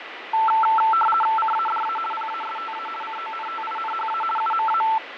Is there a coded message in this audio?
Yes: RTTY (50 baud, 450 Hz shift) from 0.3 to 5.0 s, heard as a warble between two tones, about 1110 Hz centre, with radio static and fading. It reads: CADA PASTA CONTINHA UMA